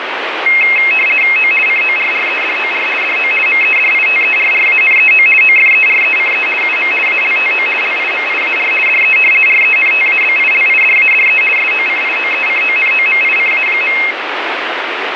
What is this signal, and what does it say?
RTTY (50 baud, 450 Hz shift), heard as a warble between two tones, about 2350 Hz centre, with radio static. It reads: O CORREDOR DO MEDITERRANEO OFERECE UM ALTO LIMIAR DE RENTABILIDADE SOCIOECONOMICA.